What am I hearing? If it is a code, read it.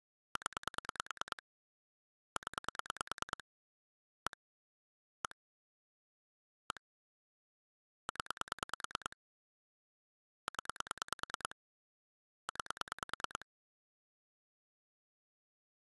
Pulse dialling, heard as clicks on a phone line, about 9 pulses a second. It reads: 0 0 1 1 1 0 0 9